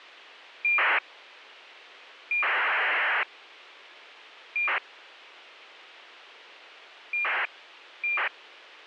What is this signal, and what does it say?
ACARS aircraft data, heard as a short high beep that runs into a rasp, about 2400 baud, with radio hiss.